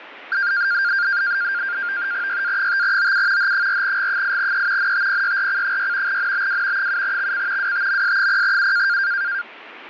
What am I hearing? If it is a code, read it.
NAVTEX (SITOR-B), 100 baud, 170 Hz shift, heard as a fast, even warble, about 1500 Hz centre, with radio static. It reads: YA5OU H4G8E NTPYRC6 NBW 7XC WTMS0U